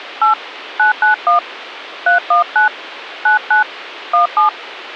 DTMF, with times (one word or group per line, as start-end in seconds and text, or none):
0.2-0.3 8
0.8-1.4 991
2.1-2.7 319
3.3-3.6 99
4.1-4.5 17